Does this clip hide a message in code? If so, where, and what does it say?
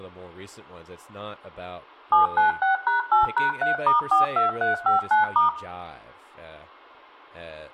Yes: DTMF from 2.1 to 5.5 s, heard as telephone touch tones, dialled by machine, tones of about 140 ms, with room echo and speech in English. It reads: 796#8#3*42359*